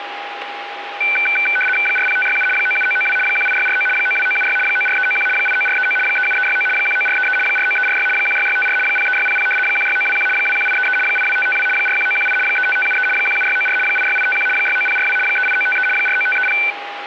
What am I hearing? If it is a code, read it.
RTTY (75 baud, 850 Hz shift), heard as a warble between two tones, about 1950 Hz centre, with radio static and a steady whistle near 810 Hz. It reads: 40567 97992 18649 92976 94391 89439 37369 19433 49346 16654 03600 16921 21833 82552 41918 35573 17694 86851 69042 38953 49530